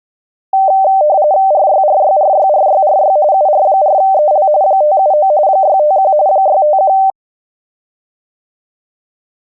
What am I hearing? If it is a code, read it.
RTTY (45.45 baud, 170 Hz shift), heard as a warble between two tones, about 690 Hz centre. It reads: RYRYRYRYRY UR4EL 579 651 651